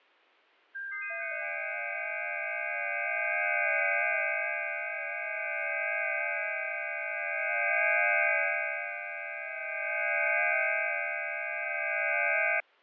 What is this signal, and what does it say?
FT8 (several signals at once), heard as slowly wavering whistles, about 6.25 baud, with fading.